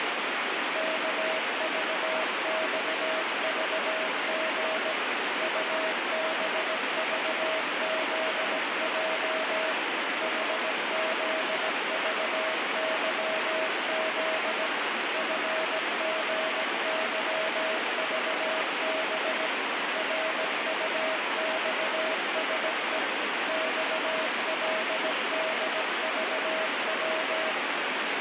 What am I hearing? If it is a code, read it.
Morse code, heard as a keyed tone, machine-sent, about 17 wpm, 640 Hz, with heavy radio static. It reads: KVXVG UBVZJ HZVYZ FGYVB RUXSE XLDVW